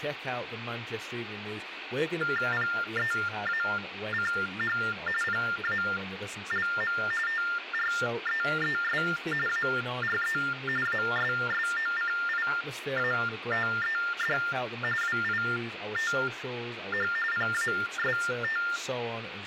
TTY/TDD text telephone tones (45.45 baud Baudot), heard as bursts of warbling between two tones, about 400 Hz shift, 1600 Hz centre, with phone line noise, room echo and speech in English. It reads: PEACH PALM TREES ARE ASSOCIATED WITH PAST